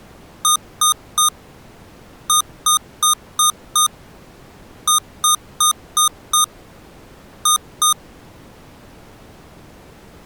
Beep code, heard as beeps from a small speaker, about 1230 Hz. 3-5-5-2.